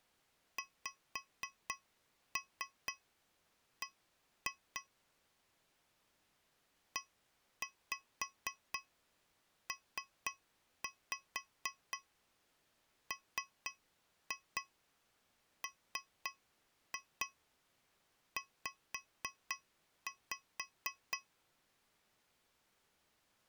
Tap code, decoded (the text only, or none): XB EPMMZ